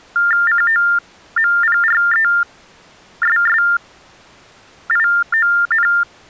TTY/TDD text telephone tones (45.45 baud Baudot), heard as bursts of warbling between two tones, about 400 Hz shift, 1600 Hz centre. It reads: COMPRESSION